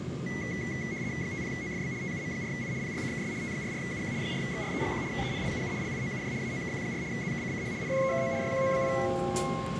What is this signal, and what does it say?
RTTY (75 baud, 170 Hz shift), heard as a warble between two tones, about 2050 Hz centre, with the noise inside a subway train. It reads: 50OFB TUM4I PRCKS T44UQ 4XRE1 ENLUU LIOUJ AOKQ4 ZKCCH NDEKO YQOBI